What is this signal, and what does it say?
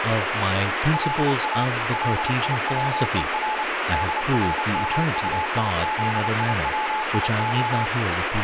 Morse code (Hebrew alphabet), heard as a keyed tone, machine-sent, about 29 wpm, 860 Hz, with radio static and speech in English. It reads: לא ליצור דרמטיזיציה